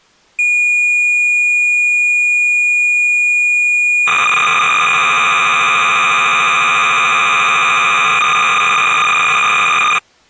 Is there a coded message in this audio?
Yes: cassette data (Kansas City type), 300 baud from 0.4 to 10.0 s, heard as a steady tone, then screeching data.